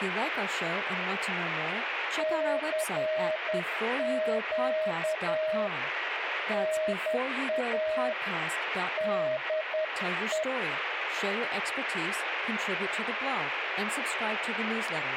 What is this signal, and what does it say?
Morse code, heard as a keyed tone, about 10 wpm, 630 Hz, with radio static and speech in English. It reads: CQ NA DE